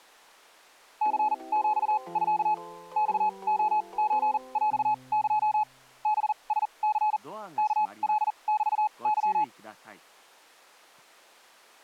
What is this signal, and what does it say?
Morse code (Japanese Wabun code), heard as a keyed tone, machine-sent, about 40 wpm, spaced as for 29 wpm, 850 Hz. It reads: ニヒミ マレソヰエ ハラニ ワカメケ